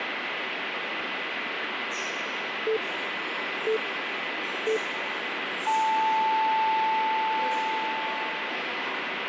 Radio time signal (three low pips and a long one an octave up, as on NHK), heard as pips, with radio static and the noise of a subway station.